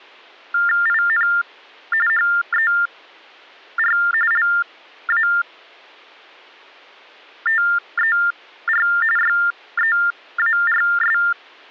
TTY/TDD text telephone tones (45.45 baud Baudot), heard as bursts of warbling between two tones, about 400 Hz shift, 1600 Hz centre. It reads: IN HER LATER YEARS